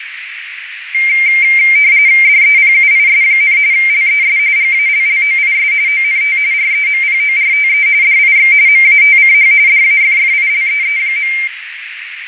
RTTY (45.45 baud, 170 Hz shift), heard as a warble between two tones, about 2200 Hz centre, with radio static, fading and a narrow filter. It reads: DEPUIS, LES GALLOIS ONT REMPORTE DIX MATCH DAFFILEE.